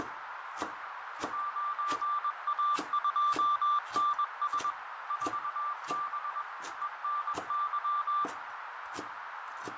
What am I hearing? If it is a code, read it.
Morse code, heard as a keyed tone, machine-sent, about 21 wpm, 1180 Hz, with heavy radio static, fading, a narrow filter and kitchen noise. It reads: 9A2NS 4B ENY